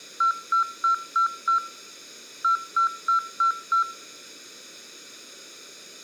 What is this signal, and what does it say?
Beep code, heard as beeps, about 1350 Hz. 5-5.